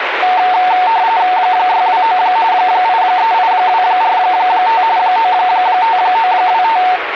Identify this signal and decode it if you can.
RTTY (45.45 baud, 170 Hz shift), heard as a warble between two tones, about 820 Hz centre, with radio static. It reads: 629 838245 95925